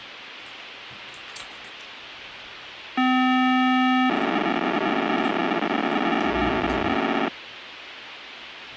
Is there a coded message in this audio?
Yes: POCSAG pager data (512 baud) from 3.0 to 7.3 s, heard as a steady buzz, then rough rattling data, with radio hiss and the noise of a restroom.